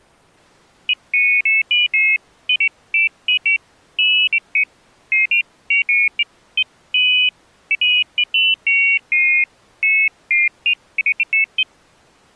Pairs of high tones at irregular times. There is no code.